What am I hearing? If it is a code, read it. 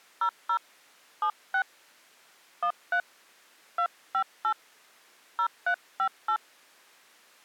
DTMF, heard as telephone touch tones, dialled by hand, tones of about 80 ms. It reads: 00 76 13 258 0358